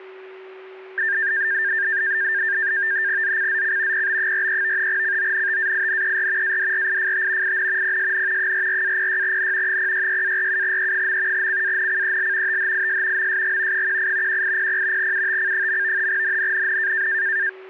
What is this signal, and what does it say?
NAVTEX (SITOR-B), 100 baud, 170 Hz shift, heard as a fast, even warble, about 1700 Hz centre, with a steady whistle near 380 Hz. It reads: ZCZC PB43 CONTAINER ADRIFT IN PSN 44-06N 066-47E. CANCEL THIS MSG 18 1800 UTC. NNNN